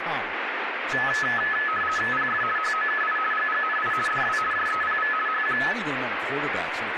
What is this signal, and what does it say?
RTTY (50 baud, 450 Hz shift), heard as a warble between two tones, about 1500 Hz centre, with radio static and speech in English. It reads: PF HOKI GGNI DW JEPV HQ